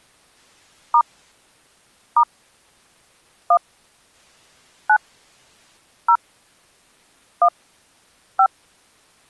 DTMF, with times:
0.9-1.0 *
2.2-2.2 *
3.5-3.6 1
4.9-5.0 9
6.1-6.2 0
7.4-7.5 1
8.4-8.5 5

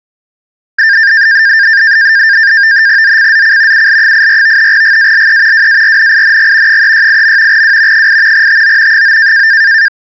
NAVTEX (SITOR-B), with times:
3.0-3.9 ZCZC
3.7-4.7 UL84
4.7-5.7 GALE
5.5-6.8 WARNING
6.7-7.6 368.
7.5-8.1 W
7.9-8.5 8
8.3-9.0 TO
8.9-9.5 9

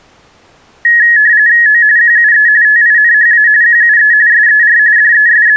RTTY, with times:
1.7-1.8 O
2.0-2.5 QUE
2.6-3.5 TINHA
3.6-4.1 QUE
4.3-4.8 SER
5.0-5.6 …

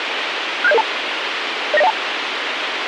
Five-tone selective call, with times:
0.6-0.8 67002
1.7-1.9 09012

